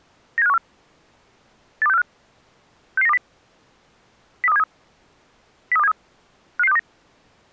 Five-tone selective call (EEA), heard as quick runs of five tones, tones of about 40 ms. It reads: 97514 82645 66920 03273 03273 55629